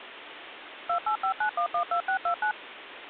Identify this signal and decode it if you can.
DTMF, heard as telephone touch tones, dialled by machine, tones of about 90 ms, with phone line noise. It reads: 2859112629